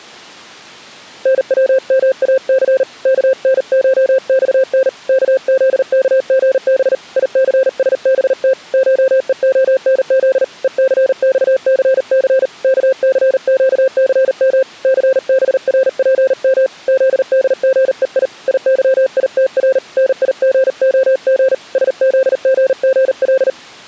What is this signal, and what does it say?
Morse code (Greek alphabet), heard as a keyed tone, hand-sent with a paddle, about 39 wpm, 530 Hz. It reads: ΝΩΜΑΘ ΚΝΧΞΝ ΚΖΚΓΒ ΙΘΣΒΤ ΧΕΟΝΖ ΕΘΞΘΘ ΚΘΨΘΜ ΘΒΡΠΜ ΖΔΓΕΙ ΙΥΙΤΡ ΝΙΓΟΓ ΣΖΓΓΛ